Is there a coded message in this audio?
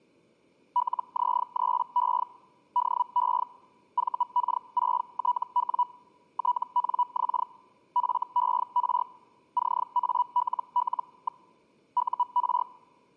Yes: Hellschreiber (Feld-Hell, 122.5 baud) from 0.8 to 12.6 s, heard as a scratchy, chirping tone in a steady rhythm, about 980 Hz. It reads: LZ3E DE VK6TW TNX FER CALL. UR